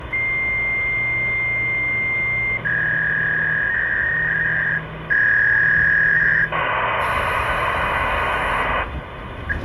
Fax machine handshake, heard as a long tone, a warble and hiss, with phone line noise and the noise inside a subway train.